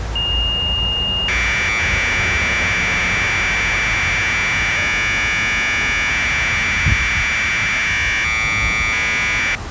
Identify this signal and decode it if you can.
Commodore tape loading (standard loader), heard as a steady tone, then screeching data, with the noise of a residential street.